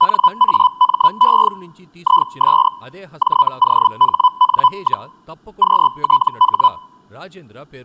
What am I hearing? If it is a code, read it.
Hellschreiber (Feld-Hell, 122.5 baud), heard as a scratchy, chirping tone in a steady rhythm, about 1000 Hz, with speech in Telugu. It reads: NAME IS JOHN, QTH